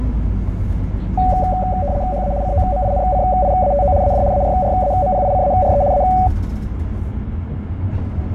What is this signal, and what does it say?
RTTY (75 baud, 170 Hz shift), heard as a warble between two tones, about 660 Hz centre, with fading and the noise inside a bus. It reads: HA COMINCIATO AD ARRAMPICARE A